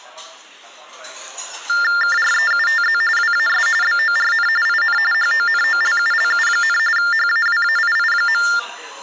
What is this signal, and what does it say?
TTY/TDD text telephone tones (45.45 baud Baudot), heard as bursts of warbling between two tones, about 400 Hz shift, 1600 Hz centre, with the noise of a restaurant. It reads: KREUTZ WAS BORN IN HONOLULU, HAWAII.